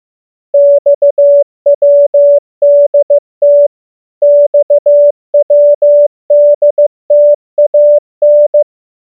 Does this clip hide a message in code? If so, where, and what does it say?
Yes: Morse code (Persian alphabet) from 0.5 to 8.7 s, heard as a keyed tone, machine-sent, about 15 wpm, 580 Hz. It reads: خودت خودتان